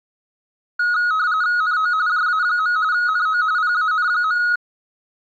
RTTY (45.45 baud, 170 Hz shift), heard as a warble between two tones, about 1360 Hz centre. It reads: NO JA. NO PAN.